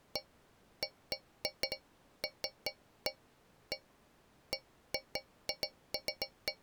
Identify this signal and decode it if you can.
Irregular taps on a metal pipe. There is no code.